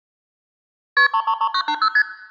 Multi-frequency trunk signalling (R1, as on North American trunks), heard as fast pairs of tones, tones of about 70 ms, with room echo. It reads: KP 333980 ST